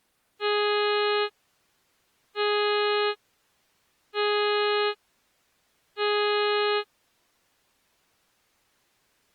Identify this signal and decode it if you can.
Ship horn signal, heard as a ship's horn, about 420 Hz. 4 short. At sea: a pilot vessel's identity signal in fog.